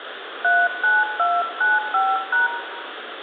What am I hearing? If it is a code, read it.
DTMF, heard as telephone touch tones, dialled by hand, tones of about 200 ms, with phone line noise and room echo. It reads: 39295#